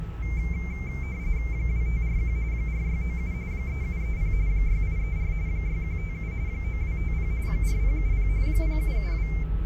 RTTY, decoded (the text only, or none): 2541 4697 3730 6834 6157 9250 4070 0772